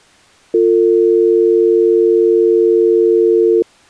Telephone call progress tone (North American or UK plan), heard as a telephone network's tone, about 350, 450 Hz. Dial tone.